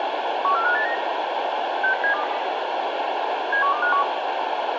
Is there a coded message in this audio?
Yes: five-tone selective call (CCIR) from 0.4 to 4.0 s, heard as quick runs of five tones, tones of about 100 ms, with radio hiss. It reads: 14589 60720 71251